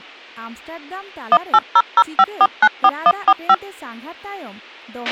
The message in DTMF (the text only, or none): 18005494145